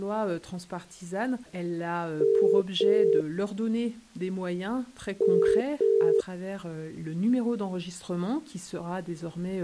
Telephone call progress tone (as in the UK, Ireland, Australia and similar networks), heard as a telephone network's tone, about 400, 450 Hz. Ringback tone.